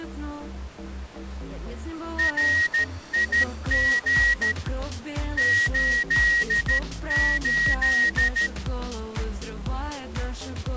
Morse code, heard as a whistle, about 13 wpm. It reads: RIG 88